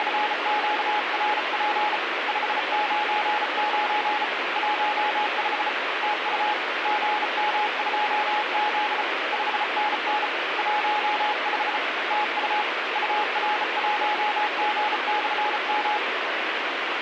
Morse code, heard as a keyed tone, hand-sent with a bug key, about 34 wpm, 840 Hz, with radio static. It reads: … 599 15 TU GM2Z 5NN 15 TU UR1G/M